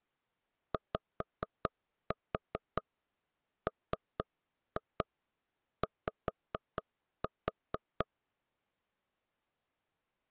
Tap code, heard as knocks on wood, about 4 knocks a second. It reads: YMY